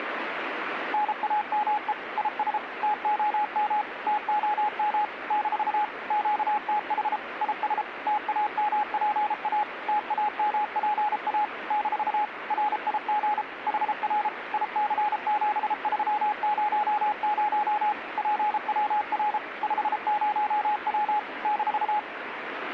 Morse code, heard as a keyed tone, machine-sent, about 33 wpm, 840 Hz, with radio static. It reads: NAME IS TOM TOM - QTH IS TAMPA TAMPA - RIG HR IC7300 PWR 50W -